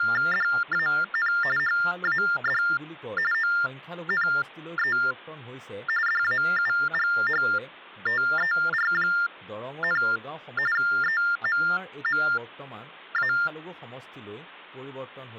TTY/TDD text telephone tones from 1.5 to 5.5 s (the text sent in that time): HAD ONE